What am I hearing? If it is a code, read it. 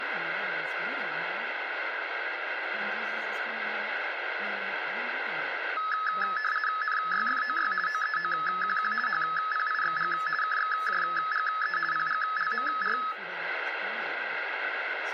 RTTY (50 baud, 450 Hz shift), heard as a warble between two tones, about 1500 Hz centre, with radio static and speech in English. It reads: NYFOY OEOQQ HPIXG KXJGE PGLMR